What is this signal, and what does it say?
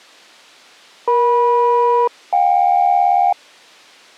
Aircraft SELCAL, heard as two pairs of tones. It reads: EM-JK